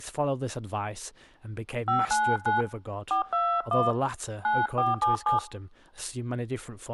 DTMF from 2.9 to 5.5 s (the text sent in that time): 421 9477